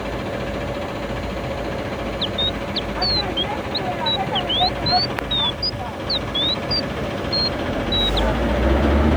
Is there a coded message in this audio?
No, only bird-like chirps, with street noise.